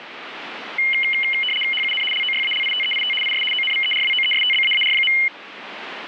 RTTY (75 baud, 850 Hz shift), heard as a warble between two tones, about 2550 Hz centre, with radio static. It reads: HUN LOYALITEIT IS ONVERWOESTBAAR.